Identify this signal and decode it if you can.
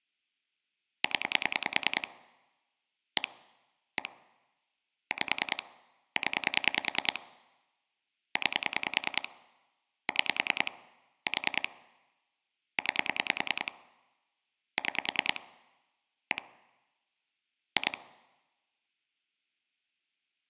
Pulse dialling, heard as clicks on a phone line, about 10 pulses a second. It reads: 0 1 1 5 0 9 6 4 9 6 1 2